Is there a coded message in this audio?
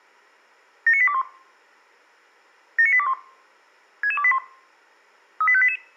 Yes: five-tone selective call (ZVEI) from 0.9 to 5.8 s, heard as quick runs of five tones, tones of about 70 ms. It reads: 79821 79821 66281 38588